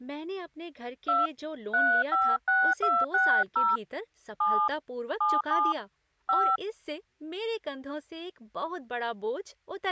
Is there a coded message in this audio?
Yes: DTMF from 1.1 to 6.6 s, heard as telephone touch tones, dialled by hand, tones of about 220 ms, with speech in Hindi. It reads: 2 356260 7 77 5